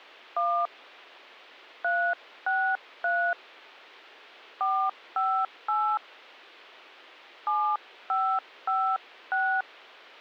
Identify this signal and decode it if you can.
DTMF, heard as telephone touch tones, dialled by hand, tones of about 290 ms. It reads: 1 363 458 7556